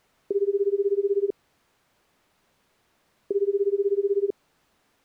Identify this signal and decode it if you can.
Telephone call progress tone (Japanese plan), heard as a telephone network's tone, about 380, 400, 420 Hz, 1 s on and 2 s off. Ringback tone.